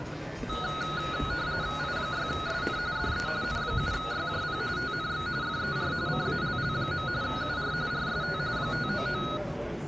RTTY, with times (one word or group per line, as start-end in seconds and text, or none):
1.8-2.8 I6SN
3.0-3.3 DE
3.4-4.6 N7YJP
4.8-5.3 TNX
5.4-5.9 FER
6.1-7.1 CALL.
7.2-7.7 UR
7.9-8.4 RST
8.6-9.2 599